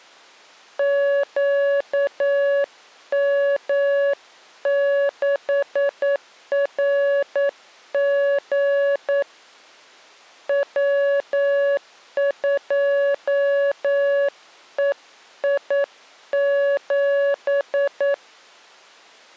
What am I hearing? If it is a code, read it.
Morse code, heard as a keyed tone, hand-sent with a paddle, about 9 wpm, 560 Hz. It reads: QM6RG W2EI7